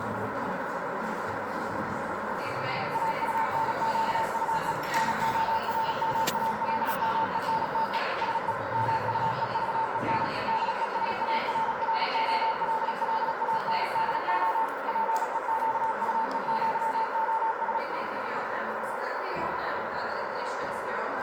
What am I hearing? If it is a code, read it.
Morse code (with Spanish letters), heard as a keyed tone, machine-sent, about 36 wpm, 890 Hz, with heavy radio static and a narrow filter. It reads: AUNQUE NORMALMENTE SE MUEVEN DESARROLLANDO PEQUEÑOS